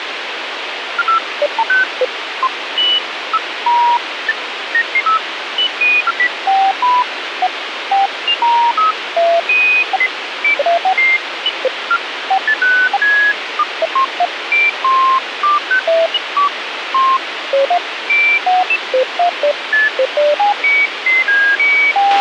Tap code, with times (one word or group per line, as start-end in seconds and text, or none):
none